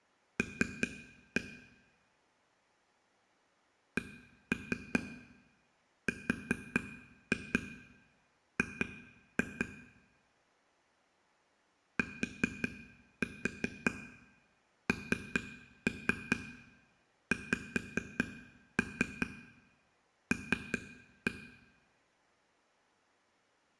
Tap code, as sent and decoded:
3-1 / 1-3 4-2 2-2 / 4-4 3-3 5-3 3-1
L CRG TNXL

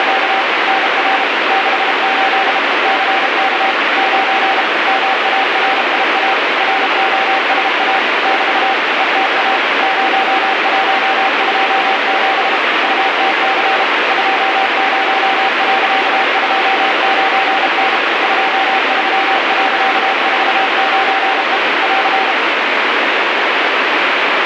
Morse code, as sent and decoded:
… / -. .-. / -.... ---.. / -.-. -.- / ----. / -- .- .-. .. .- / .-. --- ... .- / -...- / . - .- / ----- .---- ..--- --... / ..- - -.-. / ..--- ----- .-.-.- ..--- ----. -. / ..--- ...-- .-.-.- ....- ----. . / .-.-.
… NR 68 CK 9 MARIA ROSA <BT> ETA 0127 UTC 20.29N 23.49E <AR>

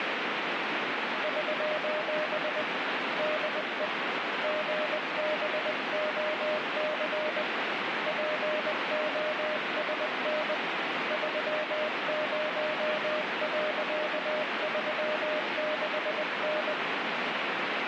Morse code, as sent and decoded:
...---... / -.. . / --. -... --- -.-. / .--. --- ... -. / ...-- ----- .-.-.- ...-- -.... -.
<SOS> DE GBOC POSN 30.36N

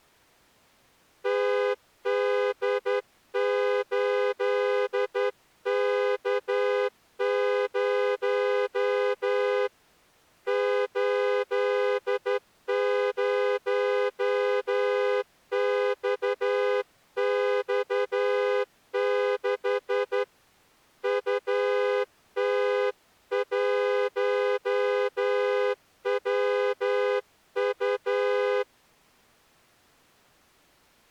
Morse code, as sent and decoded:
- -.. ---.. -.- ----- / ---.. ----- -..- -..- -.... / ..- - .---- .-- ..-
TD8K0 80XX6 UT1WU

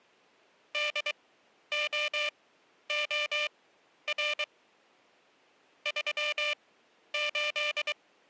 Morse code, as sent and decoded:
-.. --- --- .-. / ...-- ---..
DOOR 38

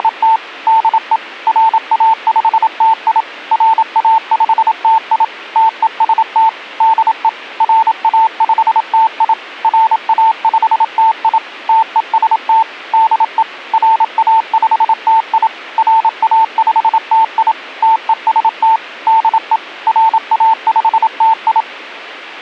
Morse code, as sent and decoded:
… / -.. . / .-. .- ..... - .. / .-. .- ..... - .. / - . ... - / -.. . / .-. .- ..... - .. / .-. .- ..... - .. / - . ... - / -.. . / .-. .- ..... - .. / .-. .- ..... - .. / - . ... - / -.. . / .-. .- ..... - ..
… DE RA5TI RA5TI TEST DE RA5TI RA5TI TEST DE RA5TI RA5TI TEST DE RA5TI

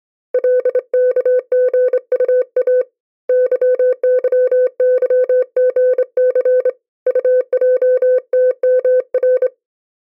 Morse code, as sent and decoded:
.-.. -.- --. ..- .- / -.-- -.-- -.-- --. -.-. / ..- .--- - -- .-.
LKGUA YYYGC UJTMR

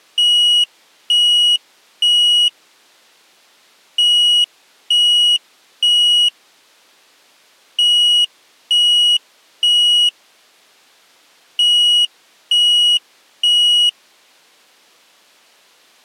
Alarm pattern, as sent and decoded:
3 beeps and a pause
temporal three

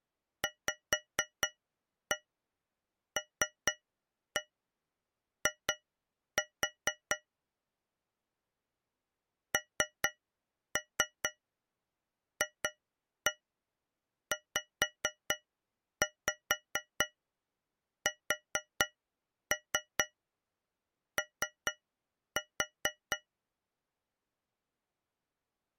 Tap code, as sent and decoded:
5-1 3-1 2-4 / 3-3 2-1 5-5 4-3 3-4
VLI NFZSO

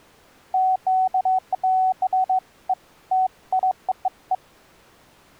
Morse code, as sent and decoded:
none

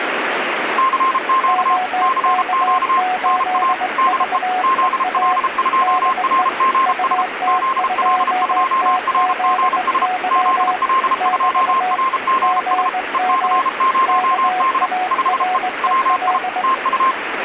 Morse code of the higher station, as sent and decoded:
-.-. --.- / -.-. --.- / -. .- / -.. . / --.. .-.. ..--- .-. --. ... / --.. .-.. ..--- .-. --. ... / --.. .-.. ..--- .-. --. ... / . -.-. ----- -.. / ..... . / .-- .. / - ..-
CQ CQ NA DE ZL2RGS ZL2RGS ZL2RGS EC0D 5E WI TU

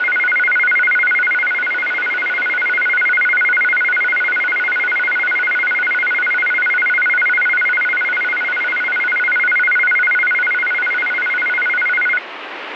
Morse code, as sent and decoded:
none

